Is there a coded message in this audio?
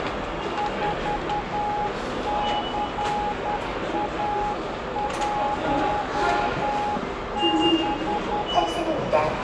Yes: Morse code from 0.5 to 8.7 s, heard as a keyed tone, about 10 wpm, 830 Hz, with radio static, a narrow filter and the noise of a subway station. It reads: 4CA16